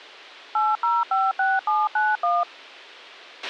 DTMF, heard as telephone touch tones, dialled by machine, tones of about 200 ms, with a squelch burst at the end. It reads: 8056791